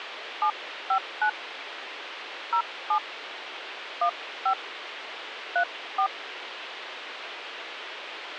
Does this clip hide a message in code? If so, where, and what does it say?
Yes: DTMF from 0.4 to 6.1 s, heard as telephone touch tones, dialled by hand, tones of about 80 ms, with radio hiss. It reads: 759 07 15 34